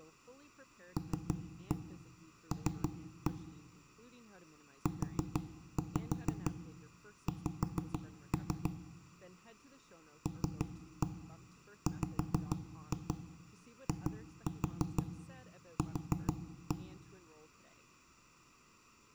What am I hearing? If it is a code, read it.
Tap code, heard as knocks on wood, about 6 knocks a second, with room echo and speech in English. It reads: LL UX LWIQ